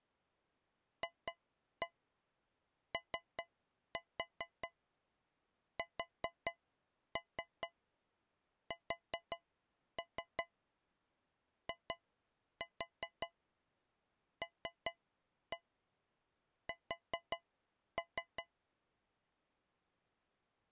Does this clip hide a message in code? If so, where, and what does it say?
Yes: tap code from 1.0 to 18.5 s, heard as taps on a metal pipe, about 5 knocks a second. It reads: FOSSILS